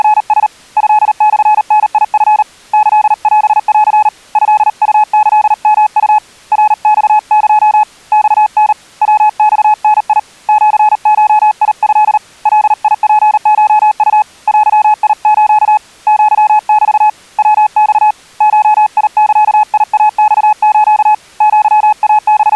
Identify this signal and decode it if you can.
Morse code (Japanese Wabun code), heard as a keyed tone, hand-sent with a paddle, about 38 wpm, 850 Hz. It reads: … トモダチ キオン トウキヨウ ナマエ マタ ヤマダ シゴト ガツコウ デス アメ ヤマ ゴザイマス …